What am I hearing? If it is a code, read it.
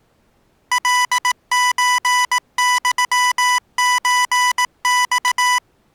Morse code (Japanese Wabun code), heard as electronic beeps, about 18 wpm, 990 Hz. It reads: カソユソマ